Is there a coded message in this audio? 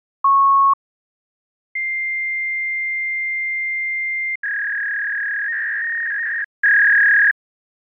Yes: fax machine handshake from 0.2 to 7.3 s, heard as a beep, a long tone and a warble.